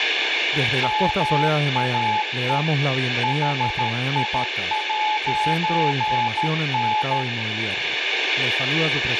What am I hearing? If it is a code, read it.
Morse code, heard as a keyed tone, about 13 wpm, 860 Hz, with radio static, room echo and speech in Spanish. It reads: MAE HI'N